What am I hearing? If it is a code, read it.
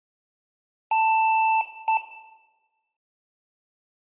Beep code, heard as beeps from a small speaker, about 880 Hz, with room echo. 1 long, 1 short. In IBM BIOS tables: system board problem.